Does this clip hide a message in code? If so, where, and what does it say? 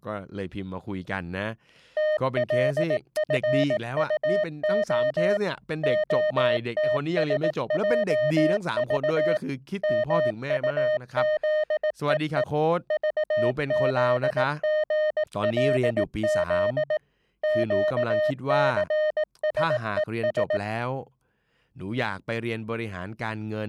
Yes: Morse code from 1.9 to 20.6 s, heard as a keyed tone, machine-sent, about 18 wpm, 610 Hz, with speech in Thai. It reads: TLFUO OTSJV MUZEE VZGLZ QCSES